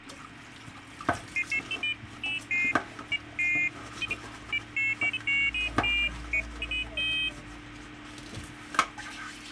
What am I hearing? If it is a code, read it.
Pairs of high tones at irregular times, with a squelch burst at the end and kitchen noise. There is no code.